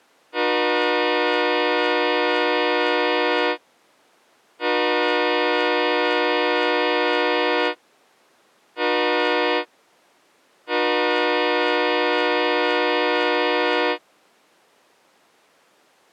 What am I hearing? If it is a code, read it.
Train horn signal, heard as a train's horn. 2 long, 1 short, 1 long. On North American railways: approaching a public crossing.